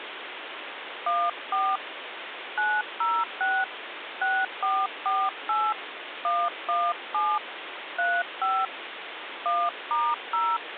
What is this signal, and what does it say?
DTMF, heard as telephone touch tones, dialled by hand, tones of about 240 ms, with phone line noise. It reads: 14 906 6448 117 35 1*0